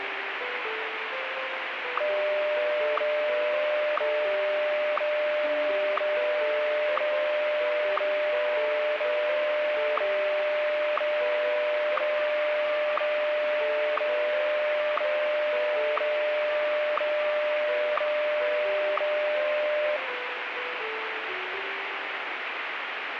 Radio time signal (WWVH, Hawaii), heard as ticks, one a second, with radio static.